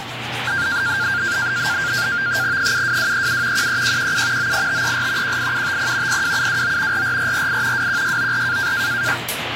NAVTEX (SITOR-B), 100 baud, 170 Hz shift, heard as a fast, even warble, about 1500 Hz centre, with radio static and the noise of a restroom. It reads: 72237 13117 98534 18750 02729 44448 21694